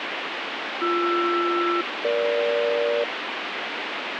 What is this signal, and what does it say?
Aircraft SELCAL, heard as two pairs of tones, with radio static. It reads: BR-EG